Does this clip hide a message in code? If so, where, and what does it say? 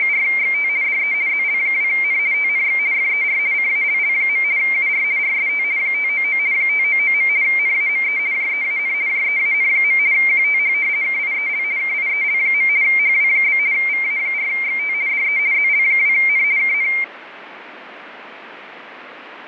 Yes: RTTY (50 baud, 170 Hz shift) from 0.0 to 17.0 s, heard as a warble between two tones, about 2200 Hz centre, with radio static. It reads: … DE ZL2N TNX FER CALL. UR RST 599 599. NAME JEAN JEAN. QTH KIEL KIEL. HW? VA4XT DE ZL2N KN